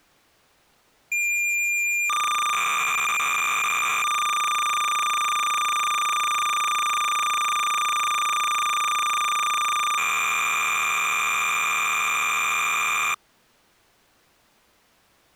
Cassette data (Kansas City type), 300 baud, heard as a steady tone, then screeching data.